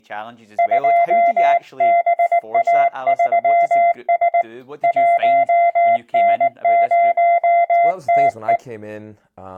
Morse code, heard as a keyed tone, hand-sent with a paddle, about 19 wpm, 690 Hz, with speech in English. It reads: 2BA3S 1N0TE